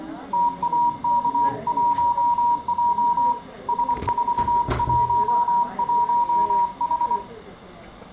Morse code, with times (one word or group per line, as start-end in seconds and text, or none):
0.3-3.3 TAK1J
3.7-7.2 S411H